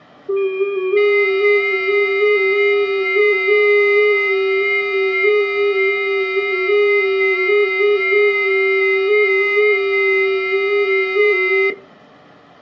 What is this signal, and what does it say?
FT8 (several signals at once), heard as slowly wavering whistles, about 6.25 baud.